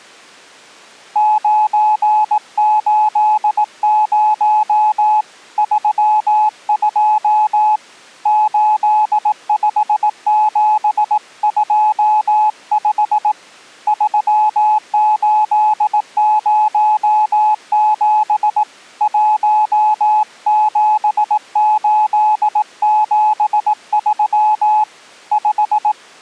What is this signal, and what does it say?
Morse code, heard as a keyed tone, hand-sent with a paddle, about 18 wpm, 850 Hz. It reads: 980 32 85725 3807 17873 5